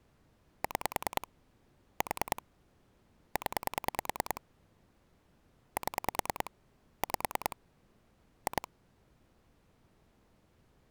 Pulse dialling, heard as clicks on a phone line, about 10 pulses a second. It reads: 6 4 0 7 5 2